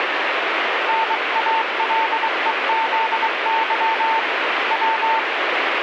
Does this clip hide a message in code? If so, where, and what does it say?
Yes: Morse code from 0.8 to 5.3 s, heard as a keyed tone, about 23 wpm, 900 Hz, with radio static. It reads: NALEZY W